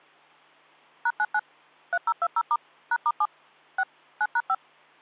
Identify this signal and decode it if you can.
DTMF, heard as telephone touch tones, dialled by machine, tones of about 50 ms. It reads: #99 3020* #*7 6 9#5